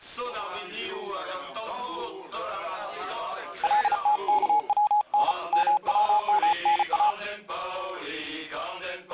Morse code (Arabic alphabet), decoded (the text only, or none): لتكون مومنا